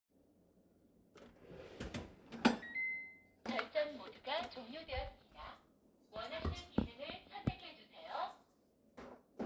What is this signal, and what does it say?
Kitchen noise. There is no code.